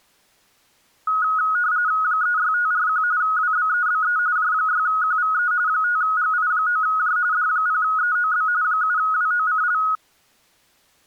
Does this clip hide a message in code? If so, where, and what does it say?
Yes: RTTY (45.45 baud, 170 Hz shift) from 1.1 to 10.0 s, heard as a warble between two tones, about 1360 Hz centre. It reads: 36541 WBEBE J6QVE 5GI9J D0EOB 7WOCL